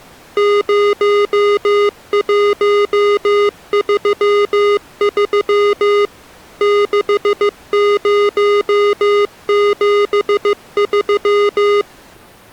Morse code, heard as electronic beeps, machine-sent, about 15 wpm, 410 Hz. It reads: 0133 6073